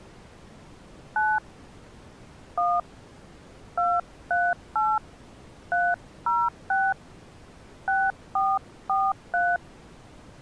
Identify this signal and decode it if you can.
DTMF, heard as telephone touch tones, dialled by hand, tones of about 220 ms. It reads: 9 1 238 306 6443